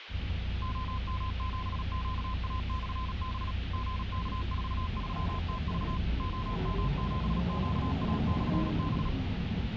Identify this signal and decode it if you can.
Morse code, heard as a keyed tone, machine-sent, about 37 wpm, 1030 Hz, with radio hiss and the noise inside a bus. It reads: OM7QA/B GK43TV OM7QA/B